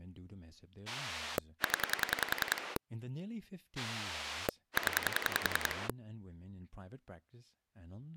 Pulse dialling, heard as a rotary dial, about 10 pulses a second, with speech in English. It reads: 0 0